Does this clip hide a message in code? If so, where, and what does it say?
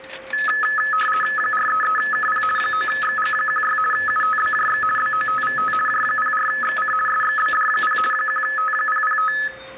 Yes: RTTY (50 baud, 450 Hz shift) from 0.3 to 9.5 s, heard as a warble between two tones, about 1500 Hz centre, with a steady whistle near 530 Hz and the noise of a restaurant. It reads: 433KP 9XG16 UTBJX BOTVT J04XC SXBD0 1T005